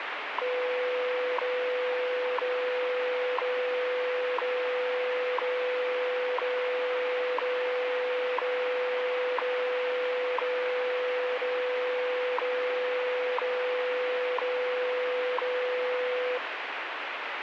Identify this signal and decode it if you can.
Radio time signal (WWV, Colorado), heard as ticks, one a second, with radio static.